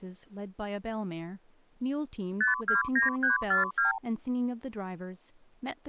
Multi-frequency trunk signalling (R2, with the far end's replies), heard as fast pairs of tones, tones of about 140 ms, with speech in English. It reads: 529342